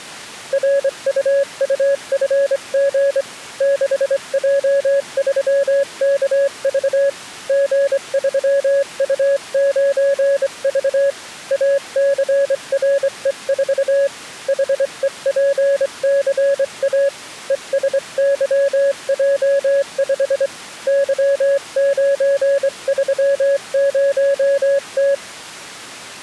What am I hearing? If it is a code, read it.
Morse code, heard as a keyed tone, hand-sent with a straight key, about 24 wpm, 560 Hz. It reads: RUUFG 6J3KV G3U9V ACRE4 HEPCA ESYJ5 Y930T